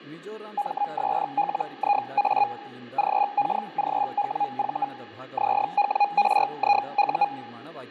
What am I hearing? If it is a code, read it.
Hellschreiber (Feld-Hell, 122.5 baud), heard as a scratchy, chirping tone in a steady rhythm, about 820 Hz, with fading and speech in Kannada. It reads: MSLIA GKGWV ZWRIU